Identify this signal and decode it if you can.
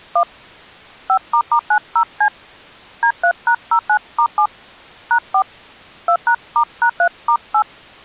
DTMF, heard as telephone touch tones, dialled by hand, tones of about 80 ms. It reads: 1 5**90C D3#09*7 #4 2#*#3*8